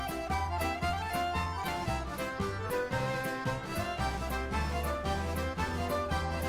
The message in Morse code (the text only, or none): none